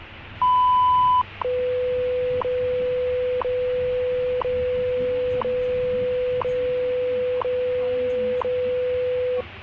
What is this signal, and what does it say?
Radio time signal (WWV, Colorado), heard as ticks, one a second, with radio static and the noise inside a bus.